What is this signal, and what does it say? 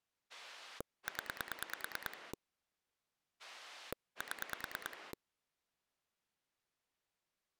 Pulse dialling, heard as a rotary dial, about 9 pulses a second. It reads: 0 7